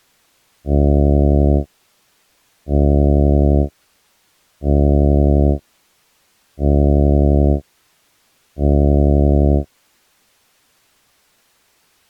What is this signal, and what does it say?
Ship horn signal, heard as a ship's horn, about 70 Hz. 5 short. At sea: I doubt that you are doing enough to avoid a collision.